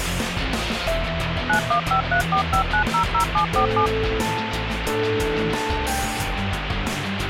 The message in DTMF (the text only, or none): 915345900747